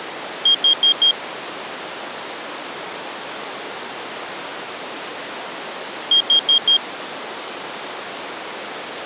Alarm pattern, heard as an alarm's beeps, played twice, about 3250 Hz. Temporal four. Carbon monoxide.